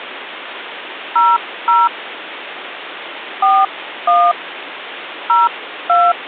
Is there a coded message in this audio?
Yes: DTMF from 1.2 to 6.1 s, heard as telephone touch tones, dialled by hand, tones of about 230 ms, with phone line noise. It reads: 00 41 02